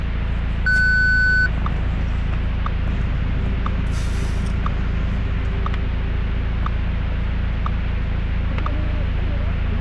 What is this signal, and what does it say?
Radio time signal (WWVH, Hawaii), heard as ticks, one a second, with static crashes and the noise inside a car.